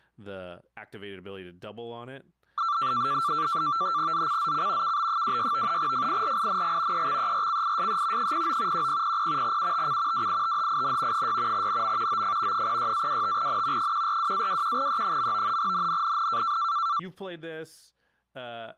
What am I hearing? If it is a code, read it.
NAVTEX (SITOR-B), 100 baud, 170 Hz shift, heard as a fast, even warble, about 1260 Hz centre, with speech in English. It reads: ZCZC KB26 FIRING EXERCISE 09 1000 UTC WITHIN 6 NM OF 06-25N 142-21E. NNNN